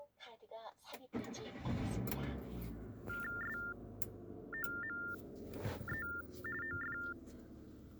TTY/TDD text telephone tones (45.45 baud Baudot), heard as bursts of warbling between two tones, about 400 Hz shift, 1600 Hz centre, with the noise inside a car. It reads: SOME OF